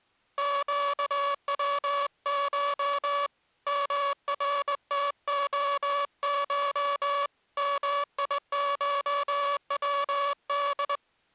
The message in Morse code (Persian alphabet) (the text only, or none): گوش مرتعش میشود